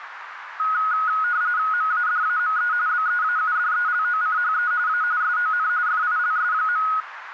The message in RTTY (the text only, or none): MADAME BEAUDELOCHE A SON FILS.